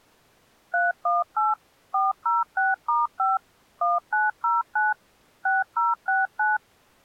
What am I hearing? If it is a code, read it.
DTMF, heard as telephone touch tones, dialled by machine, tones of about 180 ms. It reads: 318 406*5 1909 6069